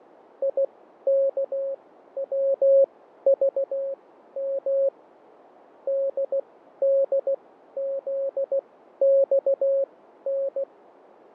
Morse code, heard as a keyed tone, machine-sent, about 16 wpm, spaced as for 12 wpm, 550 Hz, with radio static and fading. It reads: IKWVM DDZXN